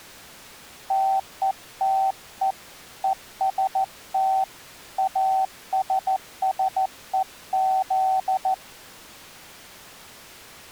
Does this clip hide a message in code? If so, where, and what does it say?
Yes: Morse code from 0.8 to 8.6 s, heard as a keyed tone, hand-sent with a paddle, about 14 wpm, 770 Hz. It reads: TETE EST ASSEZ